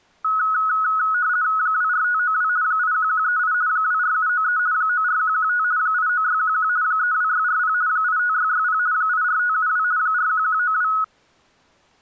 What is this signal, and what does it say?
RTTY (50 baud, 170 Hz shift), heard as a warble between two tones, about 1370 Hz centre. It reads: 24592 81138 24793 94115 89611 32640 85660 84572 41192